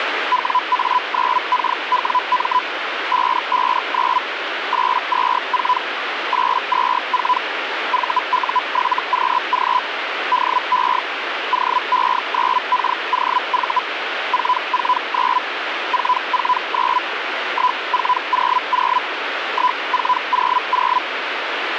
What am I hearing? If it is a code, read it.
Hellschreiber (Feld-Hell, 122.5 baud), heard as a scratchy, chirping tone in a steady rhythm, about 1000 Hz, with radio static. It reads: WA9KWM 559 824 824 VU7QG DE OE9KOV 449 449 1400 1400